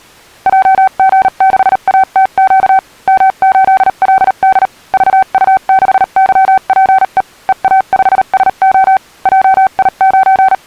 Morse code, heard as a keyed tone, machine-sent, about 38 wpm, spaced as for 34 wpm, 770 Hz. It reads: JG6ATQ M8LD VU6YPE EA5SO …